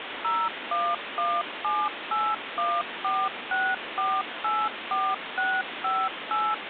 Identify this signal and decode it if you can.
DTMF, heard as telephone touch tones, dialled by machine, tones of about 240 ms, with phone line noise. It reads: 01178146484658